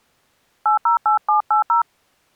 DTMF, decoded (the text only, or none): 808780